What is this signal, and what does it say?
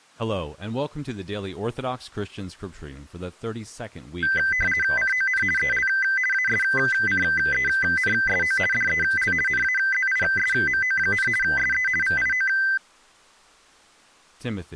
RTTY (50 baud, 450 Hz shift), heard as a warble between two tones, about 1800 Hz centre, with speech in English. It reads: CON EL ASCENSO DEL NAZISMO, SE VIO